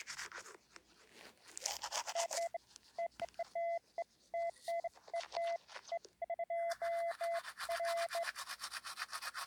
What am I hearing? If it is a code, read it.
Beeps of irregular length, with the noise of a restroom. There is no code.